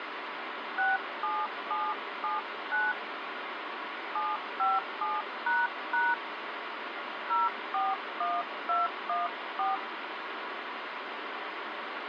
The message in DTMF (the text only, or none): 67779 757## 041214